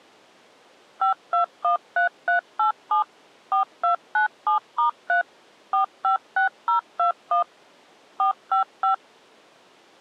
DTMF, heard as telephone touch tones, dialled by machine, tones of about 120 ms. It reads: 5213387 4297*3 456021 455